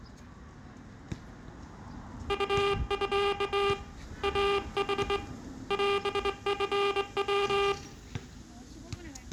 Morse code (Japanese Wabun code), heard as a buzzer, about 22 wpm, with room echo and the noise of a residential street. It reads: ウミ イヌ オチヤ